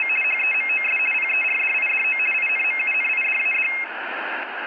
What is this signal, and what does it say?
RTTY (50 baud, 450 Hz shift), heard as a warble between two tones, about 2350 Hz centre, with radio static and room echo. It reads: … HEMOS PERDIDO INMUNIDAD